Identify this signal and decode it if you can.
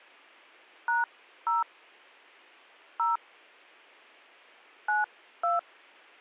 DTMF, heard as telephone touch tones, dialled by hand, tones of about 160 ms. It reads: #0 0 92